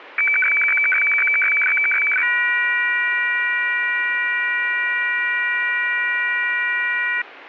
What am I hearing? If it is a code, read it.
Weather fax (radiofax), 120 lines a minute, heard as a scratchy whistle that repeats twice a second, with radio static.